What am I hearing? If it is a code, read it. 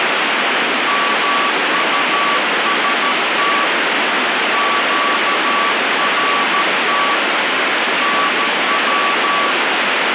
Morse code, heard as a keyed tone, hand-sent with a paddle, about 13 wpm, 1140 Hz, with heavy radio static. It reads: MUST QRT NW